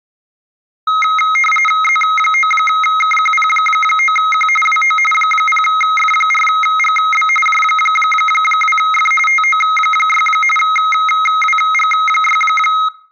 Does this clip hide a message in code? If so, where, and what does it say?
Yes: RTTY (45.45 baud, 850 Hz shift) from 0.9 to 12.9 s, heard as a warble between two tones, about 1700 Hz centre. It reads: Z9KQP9Q WO 0F4GB J2F TO6 WG6